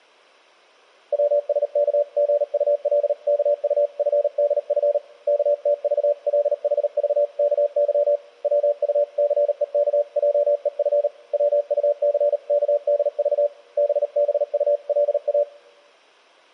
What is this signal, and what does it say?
Morse code (Korean alphabet), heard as a keyed tone, hand-sent with a paddle, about 38 wpm, 580 Hz. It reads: 병식이는 얼굴에 비창한 빛을 띠고